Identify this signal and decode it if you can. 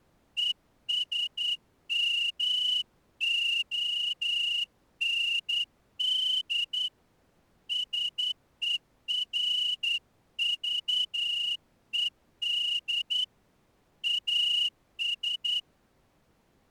Morse code, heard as a whistle, hand-sent with a straight key, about 10 wpm. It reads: ESMOND SERVED AS